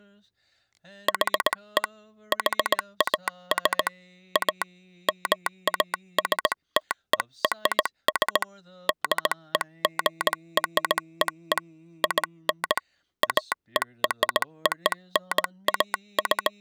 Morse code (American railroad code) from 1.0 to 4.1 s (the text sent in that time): HE HAS